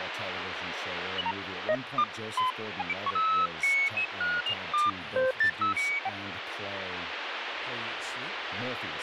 Electronic bleeps of random pitch and length, with radio static and speech in English. There is no code.